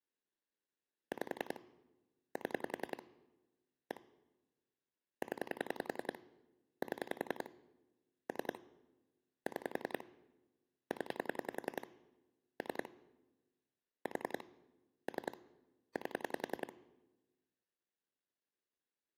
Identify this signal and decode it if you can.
Pulse dialling, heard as clicks on a phone line, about 10 pulses a second. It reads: 5 7 1 0 7 3 6 0 3 4 3 8